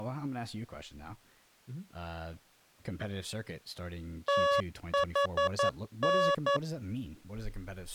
Morse code (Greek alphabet), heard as electronic beeps, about 11 wpm, 560 Hz, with speech in English. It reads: ΤΗΝ